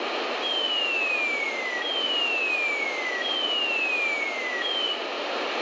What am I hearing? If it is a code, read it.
A tone that sweeps in pitch again and again, with radio static and room echo. There is no code.